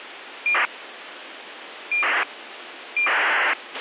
ACARS aircraft data, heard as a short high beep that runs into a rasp, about 2400 baud, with radio hiss and a squelch burst at the end.